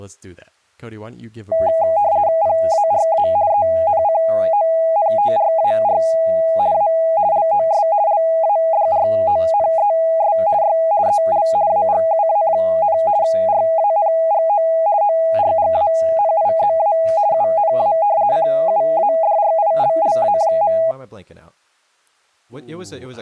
RTTY (50 baud, 170 Hz shift), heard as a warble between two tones, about 740 Hz centre, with speech in English. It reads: PARA ENCONTRAR A LOS LADRONES Y EL AGUA, RANGO ORGANIZA UNA CUADRILLA.